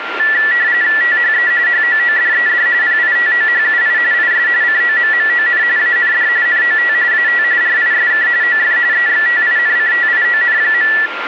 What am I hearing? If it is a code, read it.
RTTY (45.45 baud, 170 Hz shift), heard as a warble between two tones, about 1850 Hz centre, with radio static and a steady whistle near 1390 Hz. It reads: THE HOODED PITOHUI IS COMMON AND NOT AT RISK OF EXTINCTION.